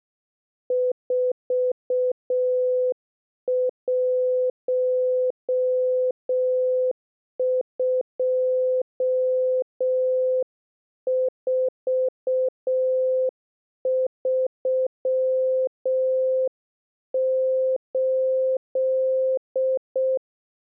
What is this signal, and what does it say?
Morse code, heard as a keyed tone, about 6 wpm, 510 Hz. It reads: 412438